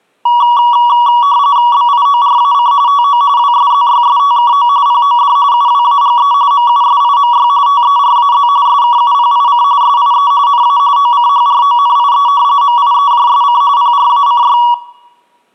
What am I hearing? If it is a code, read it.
RTTY (45.45 baud, 170 Hz shift), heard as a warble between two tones, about 1040 Hz centre, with room echo. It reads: BIORAC TO WSZYSTKO POD UWAGE MUSIMY TERAZ SKUPIC SIE NA OCHRONIE MIEJSC PRACY